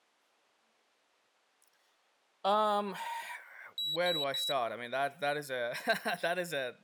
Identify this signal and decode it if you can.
Beep code, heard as a piezo beeper, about 3900 Hz, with speech in English. 3 short. In AMI BIOS tables: failure in the first 64 KB of memory; in Dell tables: chipset error.